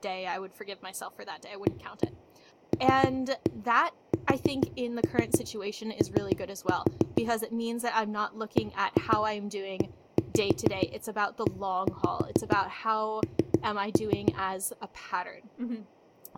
Tap code, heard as knocks on a wall, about 6 knocks a second, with room echo and speech in English. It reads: ALSO BEEN